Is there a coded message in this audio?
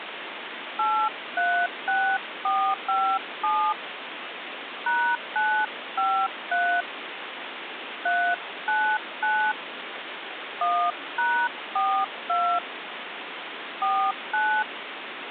Yes: DTMF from 0.8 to 14.6 s, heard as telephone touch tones, dialled by hand, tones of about 290 ms, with phone line noise. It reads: 836457 #953 399 1#42 49